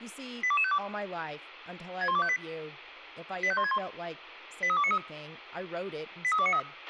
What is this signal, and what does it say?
Five-tone selective call (ZVEI), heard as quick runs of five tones, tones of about 70 ms, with a squelch burst at the end and speech in English. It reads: 82252 61258 85161 83293 83293